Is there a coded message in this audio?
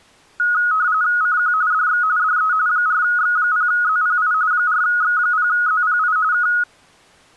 Yes: RTTY (45.45 baud, 170 Hz shift) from 0.4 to 6.6 s, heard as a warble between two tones, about 1360 Hz centre. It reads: CQ DX DE 4X0ZPI 4X0ZPI K